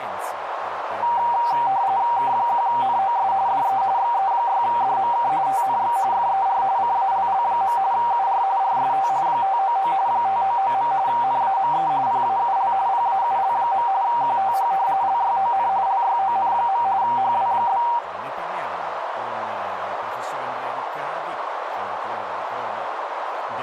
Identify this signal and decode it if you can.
RTTY (45.45 baud, 170 Hz shift), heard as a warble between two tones, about 860 Hz centre, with radio static, a narrow filter and speech in Italian. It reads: K1NOS DE XE6DMK TNX FER CALL. UR RST 599 599. NAME PAUL PAUL. QTH LYON LYON. HW?